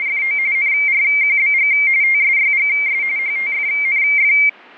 RTTY (45.45 baud, 170 Hz shift), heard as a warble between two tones, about 2200 Hz centre. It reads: … NRQBG TSYGS HTFNF